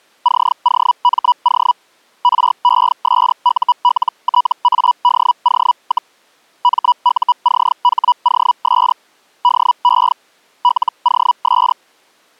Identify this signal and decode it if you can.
Hellschreiber (Feld-Hell, 122.5 baud), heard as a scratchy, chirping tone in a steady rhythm, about 980 Hz. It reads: COMO RESULTADO, MUCHOS DE LOS